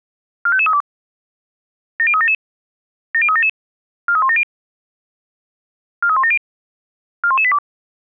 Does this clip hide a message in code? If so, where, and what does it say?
Yes: five-tone selective call (ZVEI) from 0.5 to 7.6 s, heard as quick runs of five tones, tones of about 70 ms. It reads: 45532 70377 70377 43170 43170 41182